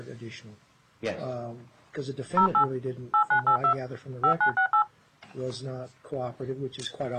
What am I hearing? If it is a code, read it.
DTMF, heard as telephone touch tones, dialled by hand, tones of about 90 ms. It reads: 08 8982 5968